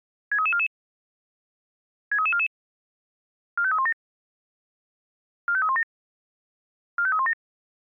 Five-tone selective call (ZVEI), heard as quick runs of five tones, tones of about 70 ms. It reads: 63344 63344 45317 45317 45317